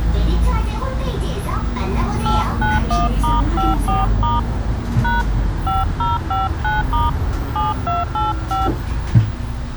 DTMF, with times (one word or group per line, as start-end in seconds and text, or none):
2.3-4.4 891*54*
5.0-5.2 #
5.7-7.1 5059*
7.6-8.7 7285